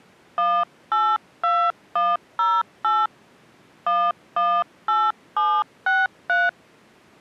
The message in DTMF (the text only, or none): 182108 118763